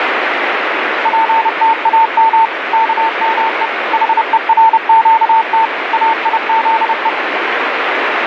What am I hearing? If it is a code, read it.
Morse code (Hebrew alphabet), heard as a keyed tone, machine-sent, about 30 wpm, 900 Hz, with radio static. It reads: פתאם כמו חורקת איזו